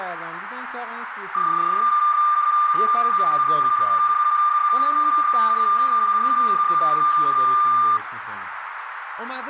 PSK31 (31.25 baud), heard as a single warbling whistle, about 1200 Hz, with radio static, a narrow filter and speech in Persian.